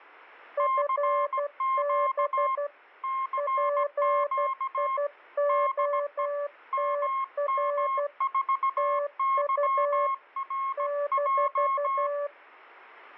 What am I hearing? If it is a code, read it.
Morse code, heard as two keyed tones. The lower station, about 12 wpm, 580 Hz: FB PIOTR TU -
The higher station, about 17 wpm, 1070 Hz: CQ CQ DE MM4YRJ